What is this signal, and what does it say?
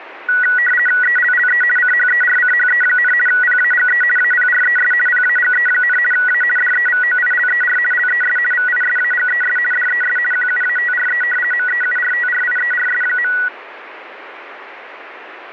RTTY (50 baud, 450 Hz shift), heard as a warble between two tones, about 1700 Hz centre, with radio static. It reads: ELLE CHERCHE, PAGE APRES PAGE, A DEVOILER LES VISAGES DES QUATRE MEURTRIERS.